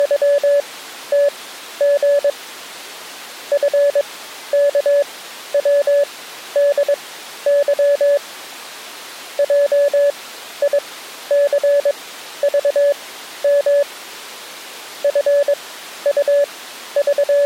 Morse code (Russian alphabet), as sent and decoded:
… / ..-. -.- .-- -.. -.-- / .--- .. -.-. ...- -- / …
… ФКВДЫ ЙИЦЖМ …

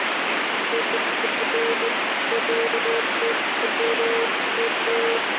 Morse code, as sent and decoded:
none

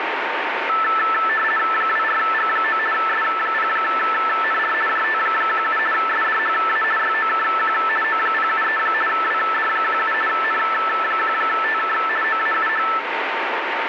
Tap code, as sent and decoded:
none

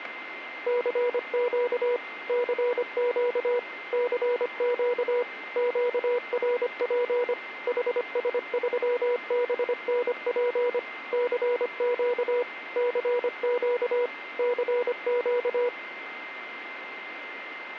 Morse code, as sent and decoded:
-.-. --.- / -.-. --.- / -.-. --.- / --.- .-. .--. / .... ... ...-- -... -. .--. / -.-. --.- / -.-. --.- / -.-. --.-
CQ CQ CQ QRP HS3BNP CQ CQ CQ

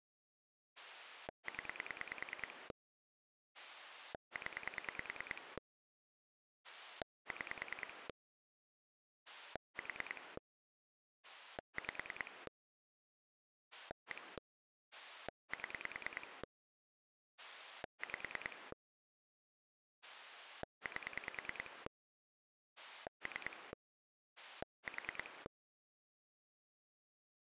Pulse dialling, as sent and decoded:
10 / 10 / 6 / 4 / 5 / 1 / 7 / 5 / 8 / 3 / 4
0 0 6 4 5 1 7 5 8 3 4

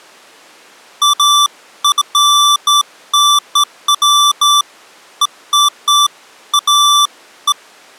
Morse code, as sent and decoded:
none

